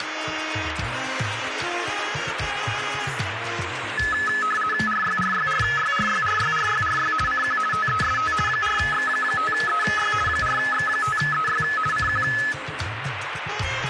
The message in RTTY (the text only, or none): RYRYRYRYRYRYRY CQ TEST 4X5EY 4X5EY CQ